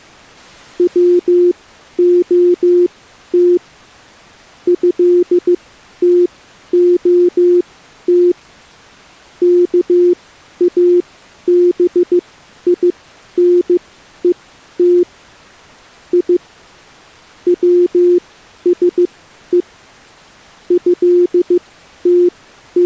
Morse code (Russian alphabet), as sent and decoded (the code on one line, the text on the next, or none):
.-- --- - / ..-.. - --- - / -.- .- -... .. -. . - / .. / .-- ... . / …
ВОТ ЭТОТ КАБИНЕТ И ВСЕ …